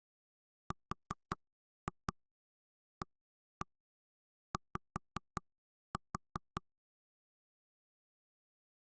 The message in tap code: RAY

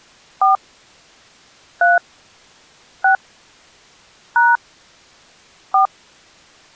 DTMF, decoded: 4 3 6 # 4

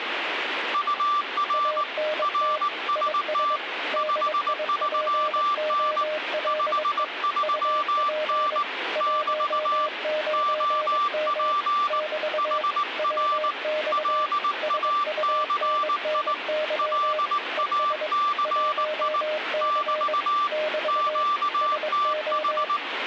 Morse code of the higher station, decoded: UR RST 53N 53N <BT> OP HR LACI LACI <BT> QTH

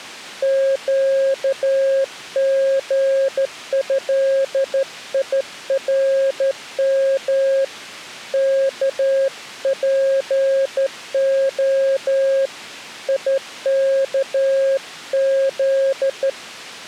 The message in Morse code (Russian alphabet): ЩГЭИРМ КПО ИКЗ

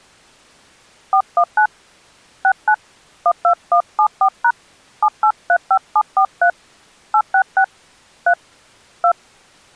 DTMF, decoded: 419 69 12174# 7835743 866 3 2

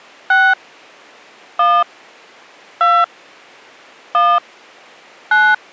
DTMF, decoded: 6 1 2 1 9

